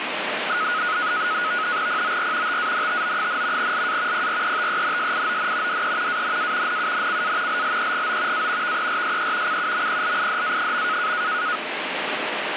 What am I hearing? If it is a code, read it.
NAVTEX (SITOR-B), 100 baud, 170 Hz shift, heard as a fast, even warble, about 1360 Hz centre, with radio static. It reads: POR TANTO, LA PRETENSION DE ANA NUNCA LLEGO A VERSE CUMPLIDA.